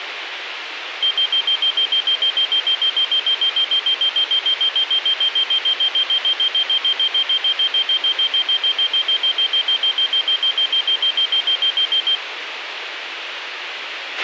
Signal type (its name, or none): none